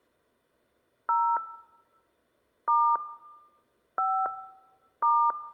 DTMF, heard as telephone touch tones, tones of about 280 ms. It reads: 0 * 5 *